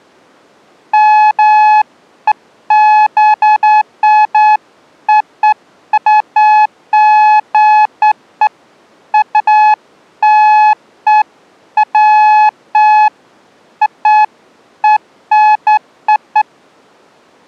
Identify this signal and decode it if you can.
Beeps of irregular length. There is no code.